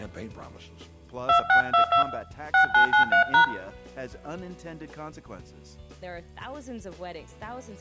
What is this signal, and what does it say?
DTMF, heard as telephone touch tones, dialled by hand, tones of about 110 ms, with room echo. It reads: 2622 6993#